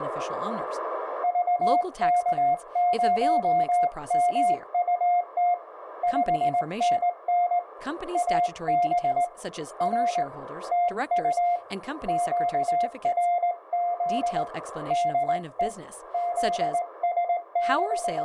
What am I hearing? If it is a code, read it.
Morse code, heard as a keyed tone, hand-sent with a straight key, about 19 wpm, 700 Hz, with radio static and speech in English. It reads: VK0MUT 5NN AB R TU QRZ DE …